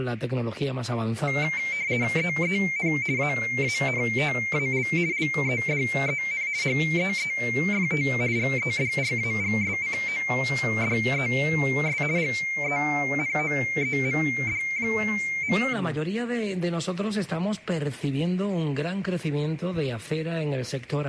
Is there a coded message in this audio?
Yes: RTTY (50 baud, 170 Hz shift) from 1.3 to 15.7 s, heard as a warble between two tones, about 2200 Hz centre. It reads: EEN AANTAL LEDEN HEEFT GEDRAGSCODES GENOEMD.